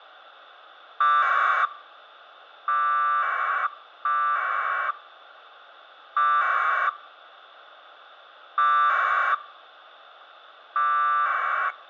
Packet radio (AX.25, as in APRS), 1200 baud, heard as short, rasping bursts.